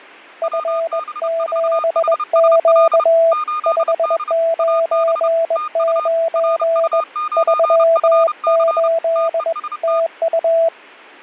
Morse code, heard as two keyed tones, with fading. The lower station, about 21 wpm, 660 Hz: F7Q 599 38 TU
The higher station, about 30 wpm, 1220 Hz: WB4HSL 8D AB TU RU9FC TEST